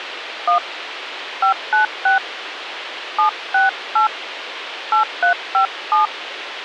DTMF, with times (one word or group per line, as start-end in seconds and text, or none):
0.5-0.6 1
1.4-2.2 596
3.2-4.1 768
4.9-6.1 8357